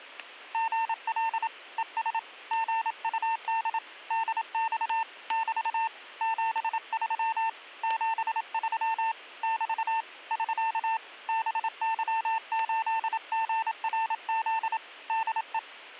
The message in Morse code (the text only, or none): GL ES GUD DX <BT> 73 73 <BT> <SK> BY8GRZ DE